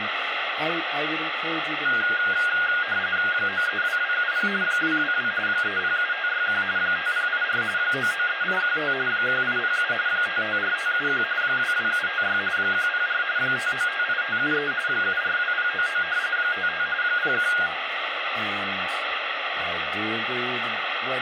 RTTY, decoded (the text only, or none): 932270 222 307561 5084 993815 1807 554571 22756 104 5958573 742099 55 01